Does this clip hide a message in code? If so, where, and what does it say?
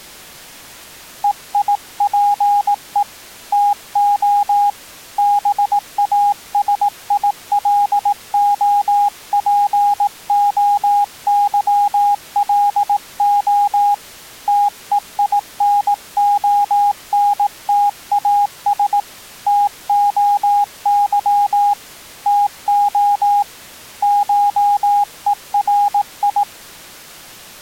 Yes: Morse code (Greek alphabet) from 1.2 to 26.5 s, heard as a keyed tone, hand-sent with a paddle, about 18 wpm, 820 Hz. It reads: ΕΙΠΕ ΤΟ ΒΑΣΙΛΟΠΟΥΛΟ ΤΕΙΝΟΝΤΑΣ ΤΟΥ ΤΟ ΧΕΡΙ